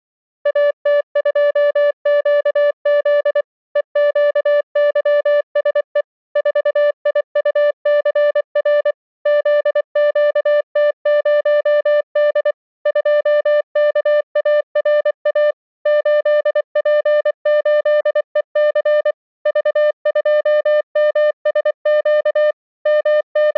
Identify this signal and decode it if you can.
Morse code, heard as a keyed tone, machine-sent, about 24 wpm, 590 Hz. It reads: AT2QZ EQYSE 4IUCR ZQT0D 2KARA 8P8EC V2MSQ …